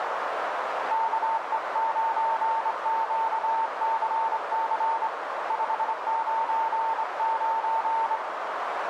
Morse code, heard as a keyed tone, hand-sent with a straight key, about 25 wpm, 900 Hz, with radio static and a narrow filter. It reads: KE9QCC 599